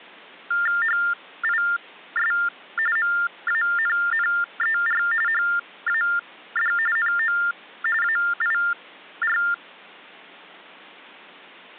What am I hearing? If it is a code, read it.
TTY/TDD text telephone tones (45.45 baud Baudot), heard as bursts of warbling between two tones, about 400 Hz shift, 1600 Hz centre. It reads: HIS MANNER HAD NO AIR